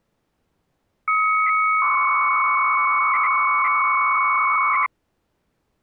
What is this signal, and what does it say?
300-baud modem data (Bell 103 tones), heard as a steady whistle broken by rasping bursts, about 300 baud, 200 Hz shift.